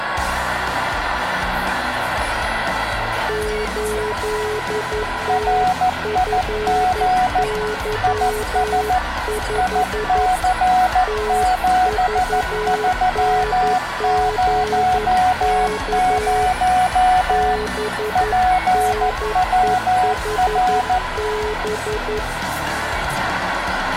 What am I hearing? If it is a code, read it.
Morse code, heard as two keyed tones, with radio static and room echo. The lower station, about 11 wpm, 430 Hz: 8TFY5 TVNGK BNEHB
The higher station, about 14 wpm, 740 Hz: RIG IS IC7300 PWR